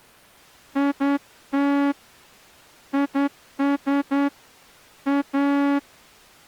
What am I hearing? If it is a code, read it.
Morse code, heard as a horn, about 10 wpm. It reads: IT IS A